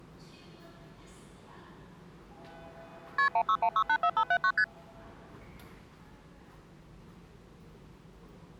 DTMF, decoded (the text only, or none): none